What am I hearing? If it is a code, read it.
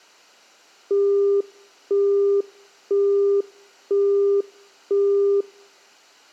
Telephone call progress tone (single-tone plan, as in Europe, Japan and elsewhere), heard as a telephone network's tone, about 400 Hz, 0.5 s on and 0.5 s off, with room echo. Busy tone.